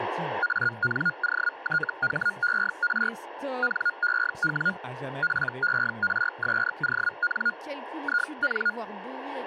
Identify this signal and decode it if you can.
Hellschreiber (Feld-Hell, 122.5 baud), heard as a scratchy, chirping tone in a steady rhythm, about 1430 Hz, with speech in French. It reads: ANOTHER NEW PERSON IN